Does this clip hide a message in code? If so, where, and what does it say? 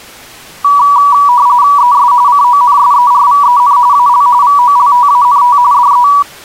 Yes: RTTY (45.45 baud, 170 Hz shift) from 0.6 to 6.2 s, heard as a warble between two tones, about 1060 Hz centre. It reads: ES CONSERVEN AL VOLTANT DE